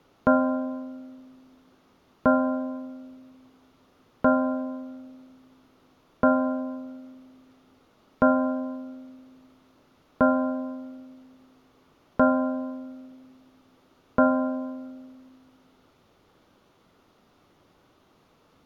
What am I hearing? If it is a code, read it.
Clock strike, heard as a bell, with room echo. 8. Eight o'clock.